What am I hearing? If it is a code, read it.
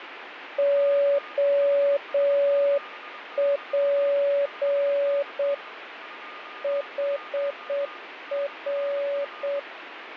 Morse code, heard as a keyed tone, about 7 wpm, 570 Hz, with radio static and a weaker station near 1220 Hz. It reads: OP HR